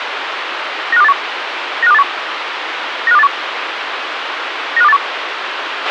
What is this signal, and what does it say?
Five-tone selective call (EEA), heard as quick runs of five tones, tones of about 40 ms, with radio hiss and a squelch burst at the end. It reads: 95281 95281 95281 95281